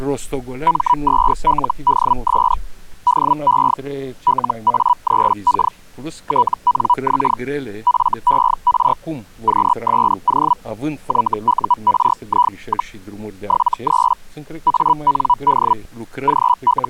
Hellschreiber (Feld-Hell, 122.5 baud), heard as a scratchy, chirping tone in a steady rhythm, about 980 Hz. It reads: M2LDS DE LA3K TNX FER QSO YURI, 73 AND …